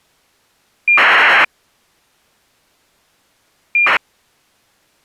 ACARS aircraft data, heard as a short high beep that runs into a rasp, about 2400 baud.